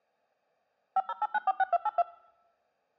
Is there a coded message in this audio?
Yes: DTMF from 1.0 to 2.0 s, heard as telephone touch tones, dialled by machine, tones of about 40 ms. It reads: 508946282